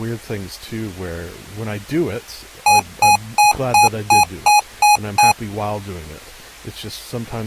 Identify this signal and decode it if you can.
Beep code, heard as beeps from a small speaker, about 830 Hz, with speech in English. 8 short. In AMI BIOS tables: display memory failure; in Dell tables: LCD failure.